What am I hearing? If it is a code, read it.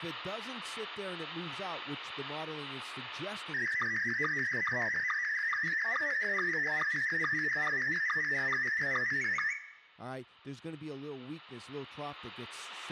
SSTV (slow-scan television), Scottie S1, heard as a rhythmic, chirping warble, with room echo and speech in English.